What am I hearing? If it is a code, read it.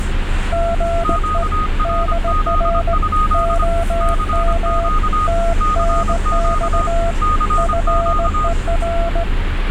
Morse code, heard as two keyed tones, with radio static and the noise inside a bus. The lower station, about 18 wpm, 680 Hz: GE DR OM TNX FER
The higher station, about 25 wpm, 1240 Hz: QRZ? CQ CQ CQ